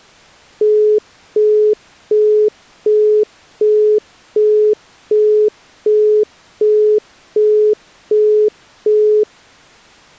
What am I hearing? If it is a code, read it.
Telephone call progress tone (as in the UK, Australia and similar networks), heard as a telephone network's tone, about 420 Hz, 0.375 s on and 0.375 s off. Busy tone.